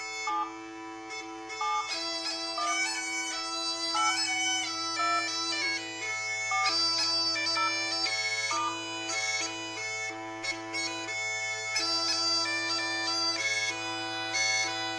DTMF, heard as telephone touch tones, dialled by hand, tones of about 160 ms, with room echo. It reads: 7 7 1 8 2 4 0 *